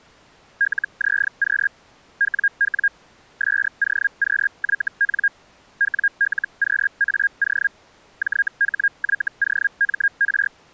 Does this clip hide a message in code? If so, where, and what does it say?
Yes: Hellschreiber (Feld-Hell, 122.5 baud) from 0.6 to 10.5 s, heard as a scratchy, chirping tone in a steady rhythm, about 1600 Hz. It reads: LZQ WW SOQYN WLQAO JHYOMR